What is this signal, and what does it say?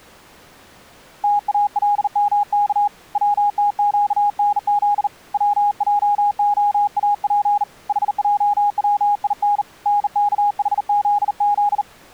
Morse code (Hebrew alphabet), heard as a keyed tone, hand-sent with a bug key, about 39 wpm, 820 Hz. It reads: תאלמך צתקנז צעהאף חעצין נכחזז